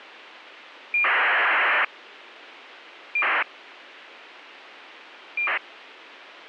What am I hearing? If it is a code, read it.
ACARS aircraft data, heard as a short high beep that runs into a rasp, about 2400 baud.